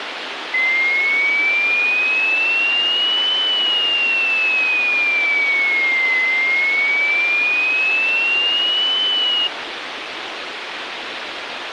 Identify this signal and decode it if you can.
A tone that sweeps in pitch again and again, with radio hiss. There is no code.